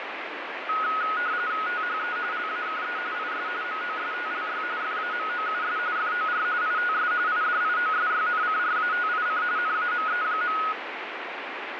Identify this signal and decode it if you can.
RTTY (45.45 baud, 170 Hz shift), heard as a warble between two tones, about 1360 Hz centre, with radio static. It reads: THE LAKE IS MOSTLY FAMOUS FOR ITS IDIOSYNCRATIC NAME.